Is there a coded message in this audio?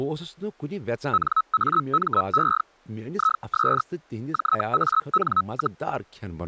Yes: Hellschreiber (Feld-Hell, 122.5 baud) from 1.1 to 5.8 s, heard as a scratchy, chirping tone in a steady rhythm, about 1290 Hz, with speech in Kashmiri. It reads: NAME IS JAN,